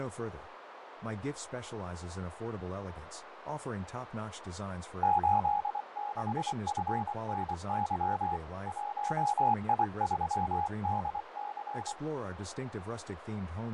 Morse code, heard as a keyed tone, hand-sent with a paddle, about 24 wpm, 830 Hz, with radio static, fading, a narrow filter and speech in English. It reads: 86FNY 1I3DC